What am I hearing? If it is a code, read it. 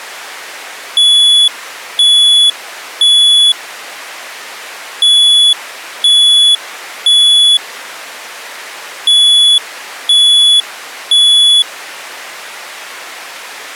Alarm pattern, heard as an alarm's beeps, played three times, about 3400 Hz. Temporal three. Smoke or fire, evacuate.